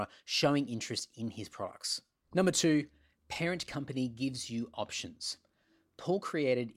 Speech in English. There is no code.